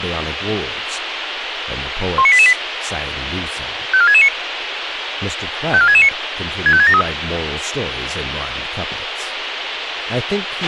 Five-tone selective call (ZVEI), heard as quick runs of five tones, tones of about 70 ms, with radio hiss, a squelch burst at the end and speech in English. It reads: 19888 54669 54669 65673